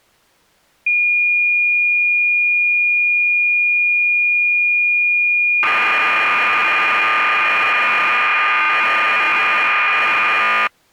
Cassette data (Kansas City type), 1200 baud, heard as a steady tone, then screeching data.